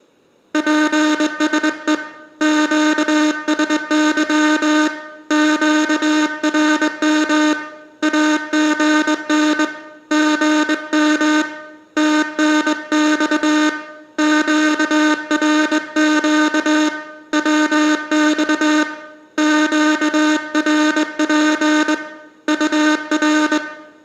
Morse code, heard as a buzzer, hand-sent with a straight key, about 21 wpm, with room echo. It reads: PSE QSY QRM AGN GM TNX QRQ WX QRP UR